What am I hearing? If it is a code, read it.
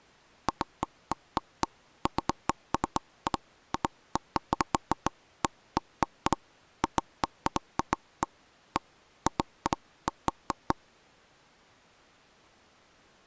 Irregular knocks on wood. There is no code.